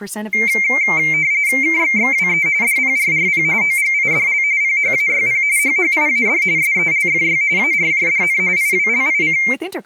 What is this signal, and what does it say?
RTTY (45.45 baud, 170 Hz shift), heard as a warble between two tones, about 2200 Hz centre, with speech in Italian. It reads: KXXWE DPRRP OGIDL PHAYP HHIAD SELFY ARJDN IWLIC